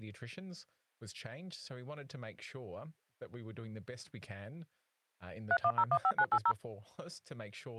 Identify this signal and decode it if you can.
DTMF, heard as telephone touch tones, dialled by machine, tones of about 60 ms, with speech in English. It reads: 31015980